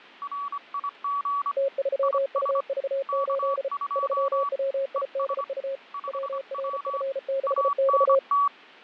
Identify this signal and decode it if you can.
Morse code, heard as two keyed tones, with radio static and fading. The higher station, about 25 wpm, 1140 Hz: RIG IS K2 ES 5W ANT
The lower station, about 34 wpm, 540 Hz: T3UV8 3WIDU WRF6X